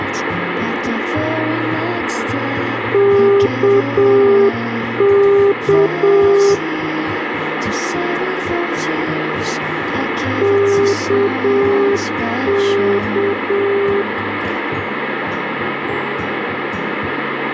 Morse code, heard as a keyed tone, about 7 wpm, 400 Hz, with radio static. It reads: KK KK